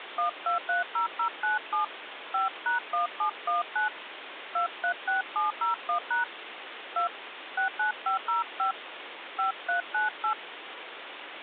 DTMF, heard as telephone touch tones, dialled by hand, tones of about 120 ms, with phone line noise. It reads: 1230097 5#1719 236701# 2 69505 5398